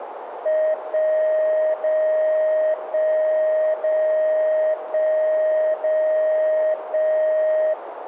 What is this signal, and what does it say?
Radio time signal (DCF77), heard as a tone whose level steps once a second, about 620 Hz, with radio static and a narrow filter. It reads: 1 0 1 0 1 0 1